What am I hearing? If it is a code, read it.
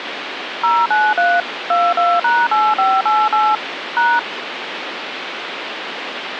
DTMF, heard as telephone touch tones, dialled by machine, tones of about 230 ms, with phone line noise. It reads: 093 22#8588 #